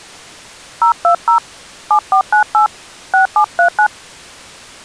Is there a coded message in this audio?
Yes: DTMF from 0.8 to 3.9 s, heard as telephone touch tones, dialled by hand, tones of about 100 ms. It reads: 020 7498 6739